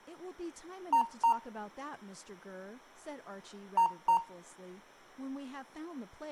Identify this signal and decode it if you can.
Beep code, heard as beeps from a small speaker, played twice, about 920 Hz, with room echo and speech in English. 2 short. In AMI BIOS tables: memory parity error; in IBM BIOS tables: self-test error shown on screen; in Dell tables: no memory detected.